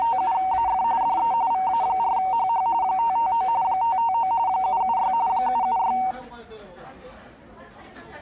RTTY (45.45 baud, 170 Hz shift), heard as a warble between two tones, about 840 Hz centre, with the noise of a restaurant. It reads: … DE VA4HH 559 559 776 776